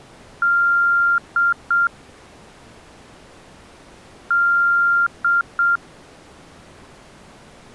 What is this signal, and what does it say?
Beep code, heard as beeps, played twice, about 1390 Hz. 1 long, 2 short. In Award, IBM and AMI BIOS tables: video adapter failure.